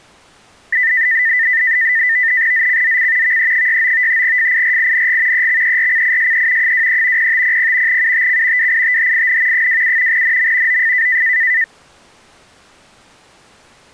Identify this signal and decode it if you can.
NAVTEX (SITOR-B), 100 baud, 170 Hz shift, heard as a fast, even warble, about 1900 Hz centre. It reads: ZCZC VE69 FIRING EXERCISE 23 0500 UTC WITHIN 27 NM OF